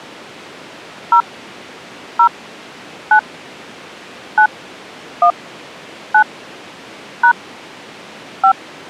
DTMF, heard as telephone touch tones, dialled by hand, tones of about 80 ms. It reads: 0 0 9 9 1 9 # 5